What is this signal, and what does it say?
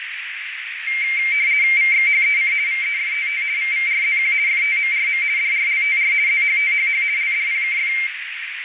RTTY (50 baud, 170 Hz shift), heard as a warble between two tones, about 2200 Hz centre, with radio static and a narrow filter. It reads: VXHEC VEFTT VVRZQ FTMRM DRLTR ZHTHH LDPKF